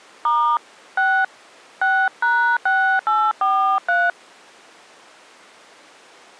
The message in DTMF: * 6 6#6843

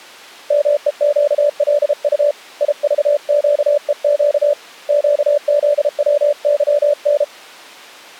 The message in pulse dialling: none

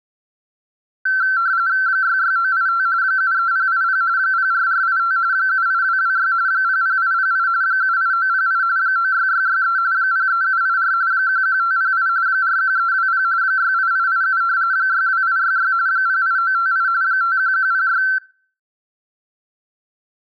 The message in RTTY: 66985 73080 04485 78226 00808 78908 96663 03784 11508 41320 68887 62866 08958 51106

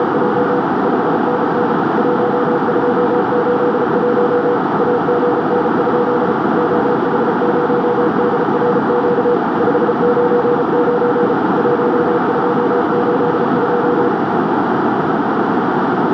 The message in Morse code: … 5NN 1281 AGN? OH0DRQ 599 1282

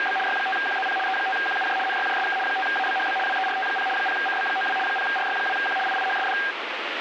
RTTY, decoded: … Y5QZP E5QUJ NYJSK 5ABHB WERT0 0CB92 0RY2Q IIHSD

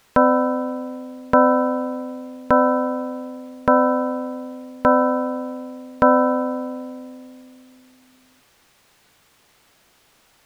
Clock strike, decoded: 6

